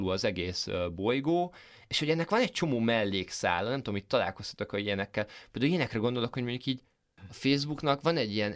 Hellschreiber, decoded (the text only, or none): none